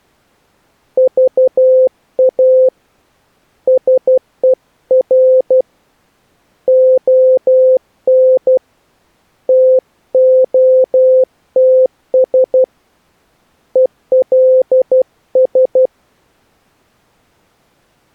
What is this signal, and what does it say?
Morse code, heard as a keyed tone, hand-sent with a paddle, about 12 wpm, 520 Hz. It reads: VA SER ON TOTS ELS